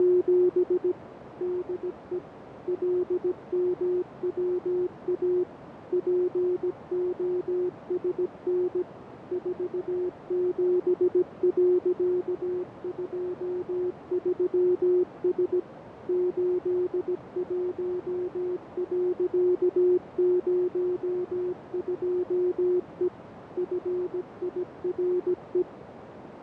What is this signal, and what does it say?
Morse code, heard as a keyed tone, machine-sent, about 17 wpm, 360 Hz, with radio static, fading and a narrow filter. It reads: … DE LMWA POSN 47.23S 81.02E FIRE